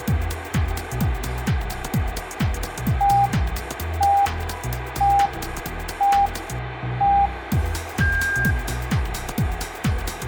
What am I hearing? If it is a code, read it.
Radio time signal (five pips and a higher one, as on Chinese radio), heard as pips, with radio static and room echo.